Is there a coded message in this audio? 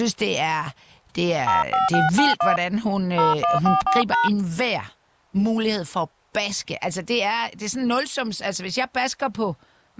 Yes: DTMF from 1.5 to 4.3 s, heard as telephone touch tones, dialled by hand, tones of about 160 ms, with speech in Danish. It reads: 05691 0144#